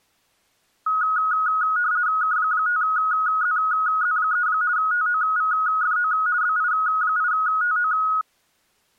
RTTY (50 baud, 170 Hz shift), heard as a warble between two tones, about 1360 Hz centre. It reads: K5ZZ3 TOVFO BI8TO